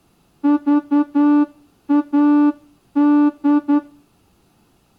Morse code, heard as a horn, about 10 wpm, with room echo. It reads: VAD